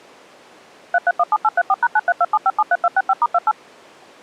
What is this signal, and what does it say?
DTMF, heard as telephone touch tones, dialled by machine, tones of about 40 ms. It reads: 3317834#9327573265*28